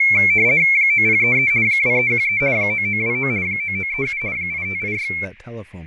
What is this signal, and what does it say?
RTTY (50 baud, 170 Hz shift), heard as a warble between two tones, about 2250 Hz centre, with fading and speech in English. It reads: 9033 2313 9929 9937 8586